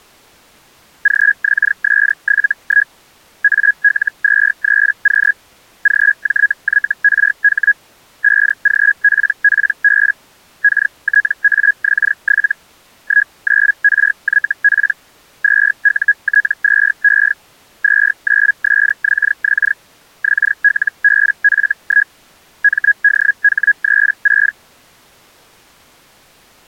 Hellschreiber (Feld-Hell, 122.5 baud), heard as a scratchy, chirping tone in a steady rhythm, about 1650 Hz. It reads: GXS71 AL23Q GJYRH 5GPPB KTAX7 19RYP 2UT2E 29SXX XLBF1 MDH36